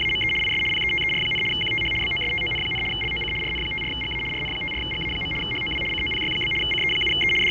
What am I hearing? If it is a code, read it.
RTTY (75 baud, 850 Hz shift), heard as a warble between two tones, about 2550 Hz centre, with fading, a steady whistle near 860 Hz and the noise inside a subway train. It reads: … IS PETER, QTH BOSTON, LOC RN54GA RN54GA. HOW COPY? CE7E …